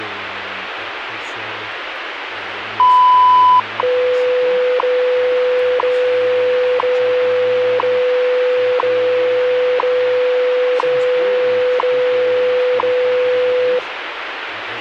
Radio time signal (WWV, Colorado), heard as ticks, one a second, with radio static.